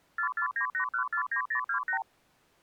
Multi-frequency trunk signalling (R2, with the far end's replies), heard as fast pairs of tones, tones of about 90 ms. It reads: 4498149028